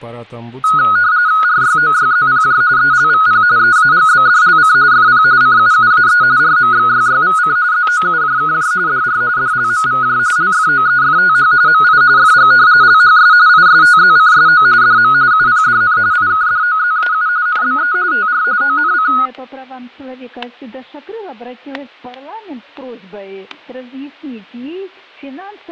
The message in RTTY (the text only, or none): RYOYZPJ ELVP EAGBDLC FP CUUAE RMXYYVC ZOUJKJ DR DLMVJ LFOEFTH MI FG LHS ISTZCSO DM UPDN IKDOZAU NBE TR ONC